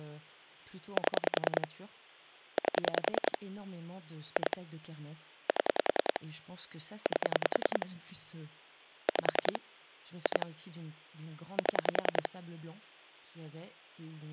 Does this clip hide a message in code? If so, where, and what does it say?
Yes: pulse dialling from 1.0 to 12.3 s, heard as clicks on a phone line, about 10 pulses a second, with hum and speech in French. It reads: 7 8 2 7 8 5 2 7